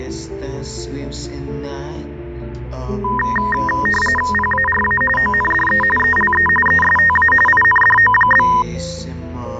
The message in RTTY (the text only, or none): PARA ONDE ELE ESTA INDO?